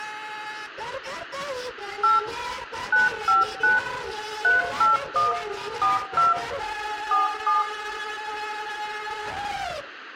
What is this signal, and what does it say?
DTMF, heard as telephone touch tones, dialled by machine, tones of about 160 ms, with room echo. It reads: 8 959 381 42 47